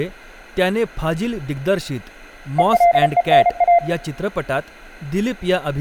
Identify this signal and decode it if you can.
Morse code (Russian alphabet), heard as a keyed tone, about 33 wpm, 690 Hz, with room echo and speech in Marathi. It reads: ЕЛЕНА